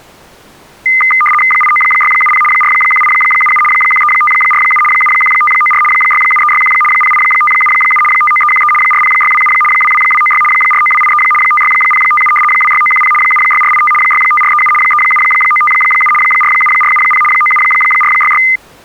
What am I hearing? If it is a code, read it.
RTTY (75 baud, 850 Hz shift), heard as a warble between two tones, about 1650 Hz centre. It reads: 89670 41877 13547 71594 67361 08577 59313 40627 22296 49283 56057 26910 76485 65437 37957 47470 97466